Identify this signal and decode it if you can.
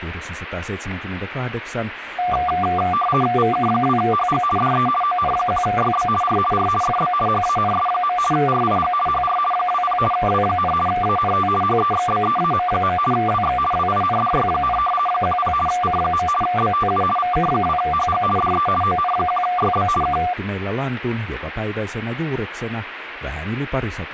RTTY (50 baud, 450 Hz shift), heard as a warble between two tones, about 950 Hz centre, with radio static and speech in Finnish. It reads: VK2HG DE ON1YB R R FB HANS. RIG HR 20 W, ANT HEXBEAM. WX WINDY, 10 C. BTU VK2HG DE ON1YB K